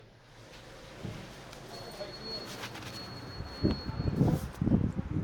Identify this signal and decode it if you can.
The noise inside a lift. There is no code.